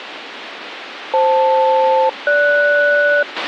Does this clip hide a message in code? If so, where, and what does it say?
Yes: aircraft SELCAL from 1.1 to 3.2 s, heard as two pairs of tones, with radio hiss and a squelch burst at the end. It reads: FL-GS